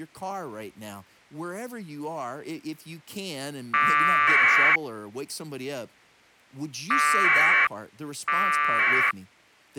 Packet radio (AX.25, as in APRS), 1200 baud, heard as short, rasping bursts, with speech in English.